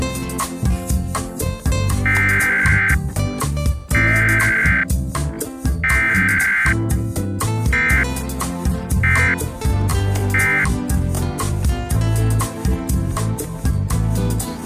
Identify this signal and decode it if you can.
Emergency Alert System (SAME) tones (header bursts, then end-of-message bursts), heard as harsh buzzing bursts, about 520.83 baud.